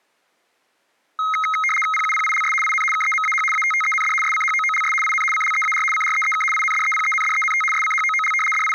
RTTY (75 baud, 850 Hz shift), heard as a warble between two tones, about 1700 Hz centre. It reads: PUPILS IN KEMAH ATTEND SCHOOLS IN CLEAR CREEK INDEPENDENT SCHOOL …